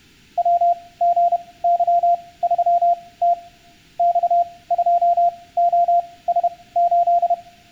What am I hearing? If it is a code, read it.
Morse code, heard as a keyed tone, machine-sent, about 31 wpm, spaced as for 20 wpm, 690 Hz, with room echo. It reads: WGY3T X2OS8